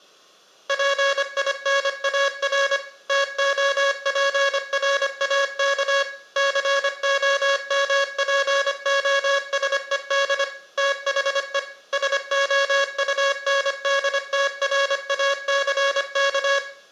Morse code, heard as a buzzer, machine-sent, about 25 wpm, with room echo. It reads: PINAR TOPRAK COMPOSED THE SOUNDTRACK